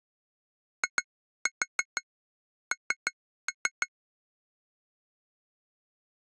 Tap code, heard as taps on glass, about 6 knocks a second. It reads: IN